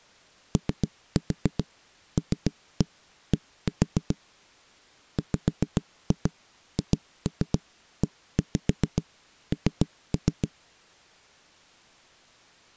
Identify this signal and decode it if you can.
Tap code, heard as knocks on a wall, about 7 knocks a second. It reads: OLD WHEN